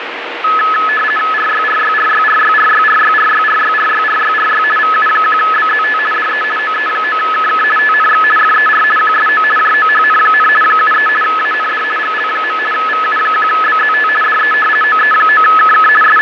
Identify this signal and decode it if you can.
RTTY (50 baud, 450 Hz shift), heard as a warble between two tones, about 1500 Hz centre, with radio static and fading. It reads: RYRYRYRYRYRYRYRYRYRYRY VU1BZT DE OE9KK TNX FER QSO JOHN, 73 AND GL. VU1BZT DE OE9KK …